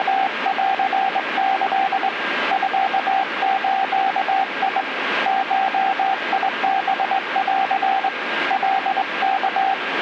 Morse code (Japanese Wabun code), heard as a keyed tone, hand-sent with a straight key, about 21 wpm, 770 Hz, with radio static and a steady whistle near 1610 Hz. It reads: … ミズ ゴハン カワ